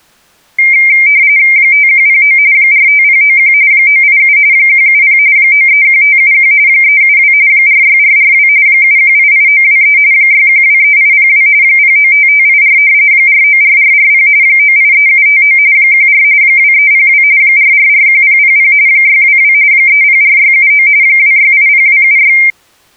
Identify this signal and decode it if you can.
RTTY (45.45 baud, 170 Hz shift), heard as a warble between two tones, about 2200 Hz centre. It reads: 5109 45091 987 170 931571 372 46442 7188923 6123802 095584 494440 983759 14 2302 4441000 622 304679 2680276